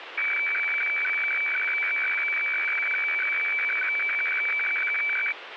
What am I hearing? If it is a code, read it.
Weather fax (radiofax), 120 lines a minute, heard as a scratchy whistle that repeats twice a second, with radio static.